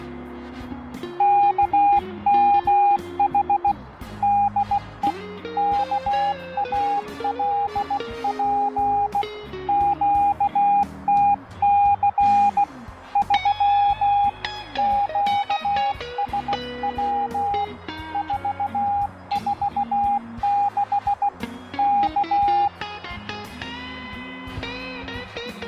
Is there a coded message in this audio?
Yes: Morse code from 1.1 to 22.7 s, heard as a keyed tone, hand-sent with a bug key, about 16 wpm, 810 Hz, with radio static. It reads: KMH DE KALP QTC 3 QSW 446 K